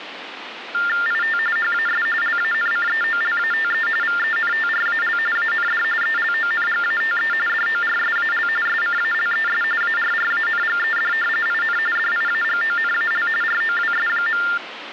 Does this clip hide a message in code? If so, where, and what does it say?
Yes: TTY/TDD text telephone tones (45.45 baud Baudot) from 0.7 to 14.6 s, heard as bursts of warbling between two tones, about 400 Hz shift, 1600 Hz centre, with phone line noise. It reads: IT HAS LANCEOLATE VENTRAL AND ELONGATE DORSAL SCALES ARRANGED IN DIAGONAL ROWS.